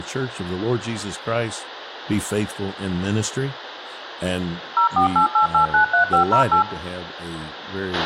DTMF, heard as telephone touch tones, dialled by machine, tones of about 110 ms, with radio hiss, a squelch burst at the end, room echo and speech in English. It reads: 0488893508